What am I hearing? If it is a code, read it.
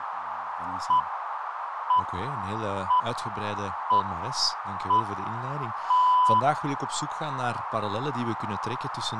Radio time signal (six pips, as the Greenwich Time Signal), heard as pips, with radio static, a narrow filter and speech in Dutch.